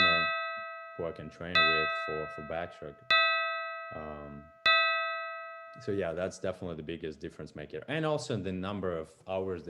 Clock strike, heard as a bell, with room echo and speech in English. 4. Four o'clock.